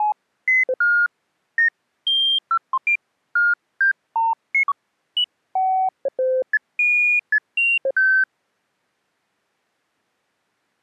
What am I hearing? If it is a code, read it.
Electronic bleeps of random pitch and length. There is no code.